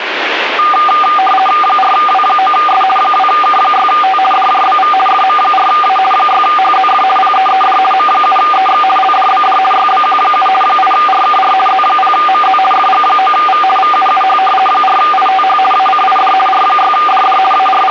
RTTY (50 baud, 450 Hz shift), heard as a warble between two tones, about 990 Hz centre, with radio static. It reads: 4W9S 2K6T DJBV FM4A 6HZF PEED M7EX LDBD YBQ7 8RKR Z0MZ FG9V VUUH 4ITH ACID R6DD …